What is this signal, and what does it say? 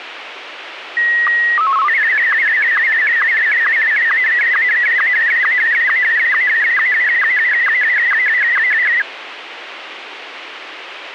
SSTV (slow-scan television), Martin M1, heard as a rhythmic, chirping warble, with radio hiss and a squelch burst at the end.